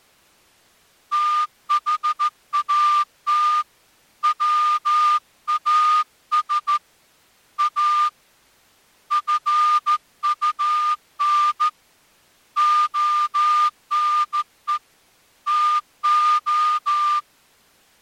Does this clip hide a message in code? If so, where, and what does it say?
Yes: Morse code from 1.1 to 17.3 s, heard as a whistle, hand-sent with a straight key, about 14 wpm. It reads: THAT WAS A FUN ONE TO